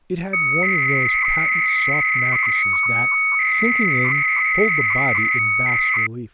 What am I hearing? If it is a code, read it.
300-baud modem data (Bell 103 tones), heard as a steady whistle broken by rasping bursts, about 300 baud, 200 Hz shift, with speech in English.